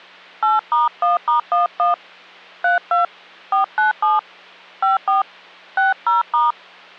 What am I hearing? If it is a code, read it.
DTMF, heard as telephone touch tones, dialled by hand, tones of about 150 ms, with hum. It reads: 8*1*11 32 497 54 60*